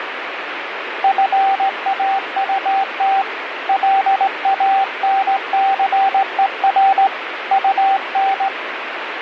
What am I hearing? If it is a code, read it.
Morse code, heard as a keyed tone, hand-sent with a straight key, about 18 wpm, 780 Hz, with radio static. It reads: FAUT LANCER UN